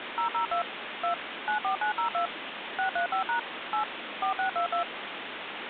DTMF, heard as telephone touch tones, dialled by machine, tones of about 110 ms, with phone line noise. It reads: 002 2 94902 635# 8 4622